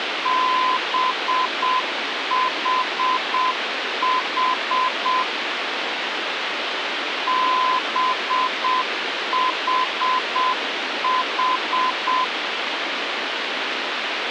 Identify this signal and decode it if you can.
Morse code, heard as a keyed tone, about 7 wpm, 1020 Hz, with radio hiss. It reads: BHH BHH